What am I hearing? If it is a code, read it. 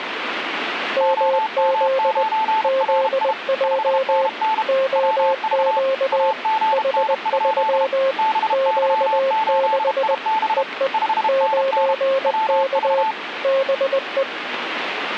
Morse code, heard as two keyed tones, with radio static. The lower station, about 20 wpm, 540 Hz: MZ ZJ OQ H3 Q6 EE 9K BE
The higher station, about 32 wpm, 880 Hz: OM9RI 5NN WV AGN? BY8IB 5NN WV